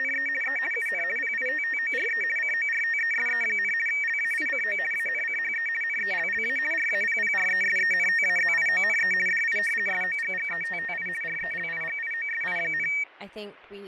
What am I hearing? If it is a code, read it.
RTTY (50 baud, 450 Hz shift), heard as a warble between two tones, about 2050 Hz centre, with fading, static crashes and speech in English. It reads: … E UN PITTORE CORTESE, LAICO ANCHE NELLA RAPPRESENTAZIONE DI SOGGETTI RELIGIOSI,